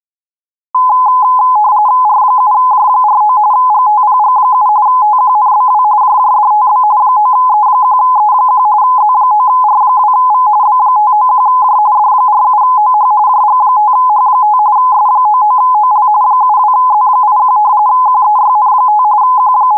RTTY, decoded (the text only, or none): R7J49 GTPG7 TQNBW JJDTB 9E1E1 Z9R2V B591J D47OH JG5H5 S99OL 72Z81 QEYN5 …